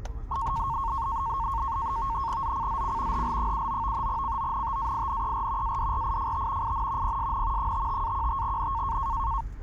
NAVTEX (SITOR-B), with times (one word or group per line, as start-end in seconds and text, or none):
2.4-3.2 ZCZC
3.1-4.1 HL79
4.1-5.8 CONTAINER
5.6-6.7 ADRIFT
6.6-7.2 IN
7.0-7.7 PSN
7.6-9.0 55-15N